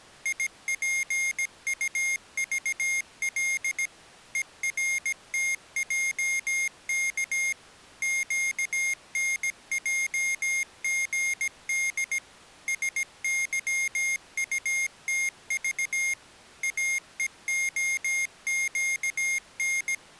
Morse code, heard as a high beeper, machine-sent, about 17 wpm, 2150 Hz. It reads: IPUVL ERTJK QNJGD SYUTV AEOQN